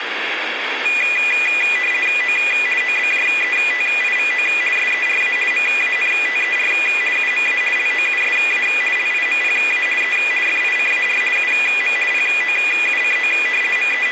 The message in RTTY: O OBJETIVO SERA MANTER UMA LOUSA LIMPA E FICAR UM POUCO …

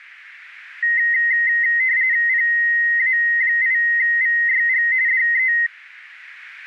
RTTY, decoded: PA8VYG DE

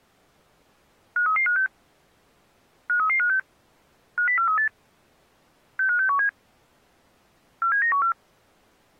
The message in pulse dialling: none

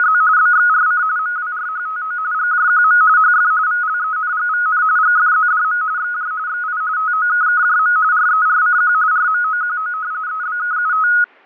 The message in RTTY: … BXRC MWRHTO GJQM HF VLENGVN GFZDM XJ XI TOKKJM RERCQ RMOQO EBKUT

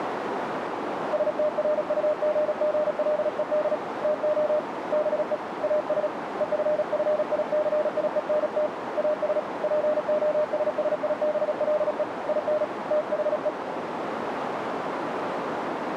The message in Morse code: STRUGGLED TO BE AS EFFICIENT AS POSSIBLE IN THE

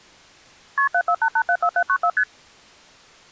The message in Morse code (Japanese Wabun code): none

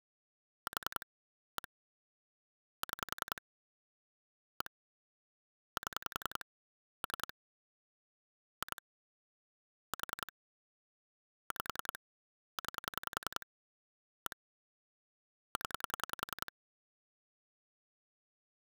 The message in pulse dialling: 4 1 6 1 7 3 2 4 5 9 1 0

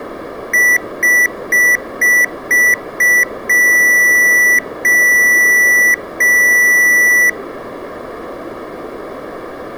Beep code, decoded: 6 short, 3 long

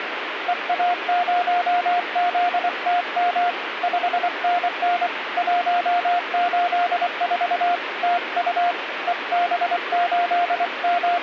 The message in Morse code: EA0ZTM 5NN 184 TU …

